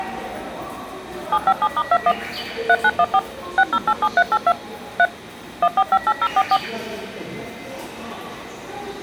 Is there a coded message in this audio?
Yes: DTMF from 1.3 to 6.6 s, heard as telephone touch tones, dialled by machine, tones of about 50 ms, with the noise of a subway station. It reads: 757*21 3914 6087382 3 1458044